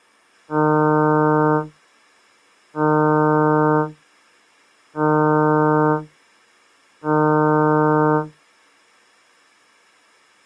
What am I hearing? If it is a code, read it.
Ship horn signal, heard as a ship's horn, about 150 Hz. 4 short. At sea: a pilot vessel's identity signal in fog.